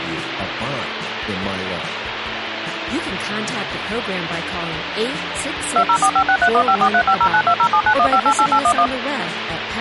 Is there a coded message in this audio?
Yes: DTMF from 5.8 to 8.9 s, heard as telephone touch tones, dialled by machine, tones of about 70 ms, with phone line noise. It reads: 204563154350920791588811